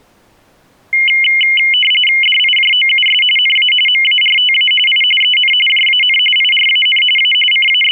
RTTY (45.45 baud, 850 Hz shift), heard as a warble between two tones, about 2550 Hz centre. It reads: DIJOUS NA MARTA I EN JAN IRAN A …